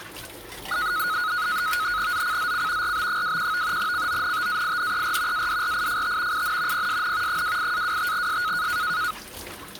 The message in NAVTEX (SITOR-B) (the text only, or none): ZCZC RB21 CONTAINER ADRIFT IN PSN 28-25S